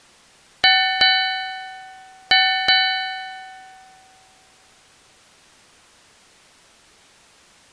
Ship's bell, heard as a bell. 4. Four half-hours of the watch have passed.